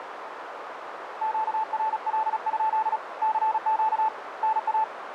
Morse code, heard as a keyed tone, hand-sent with a paddle, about 36 wpm, 880 Hz, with radio static and a narrow filter. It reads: QRL? CQ NA